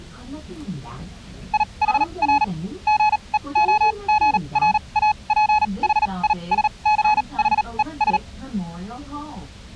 Morse code, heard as a keyed tone, machine-sent, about 38 wpm, spaced as for 28 wpm, 850 Hz, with the noise inside a bus. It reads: IHR GEOGRAPHISCHES